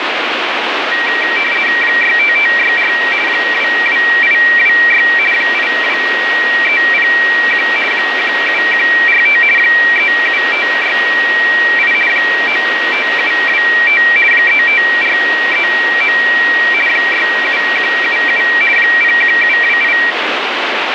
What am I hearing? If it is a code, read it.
RTTY (50 baud, 450 Hz shift), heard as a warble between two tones, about 2100 Hz centre, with radio static. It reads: 65564 22826 82301 17145 37568 95725 35439 67177 01728